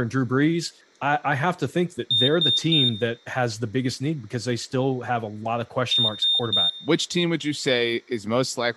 Beep code, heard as a piezo beeper, played twice, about 3650 Hz, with speech in English. 3 short. In AMI BIOS tables: failure in the first 64 KB of memory; in Dell tables: chipset error.